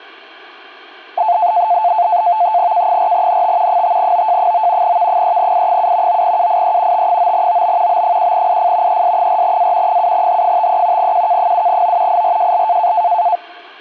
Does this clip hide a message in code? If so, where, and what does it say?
Yes: NAVTEX (SITOR-B), 100 baud, 170 Hz shift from 1.2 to 13.4 s, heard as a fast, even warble, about 790 Hz centre. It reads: K4NT 5OJ9 V3I7 9UIE T9OB B1IF ES4A 7H53 QK7O IRJL